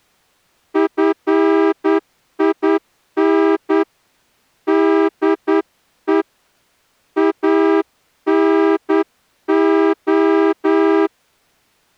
Morse code, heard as a horn, hand-sent with a straight key, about 9 wpm. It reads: FIN DE ANO